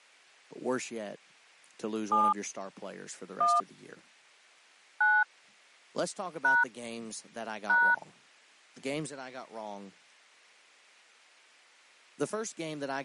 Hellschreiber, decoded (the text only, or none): none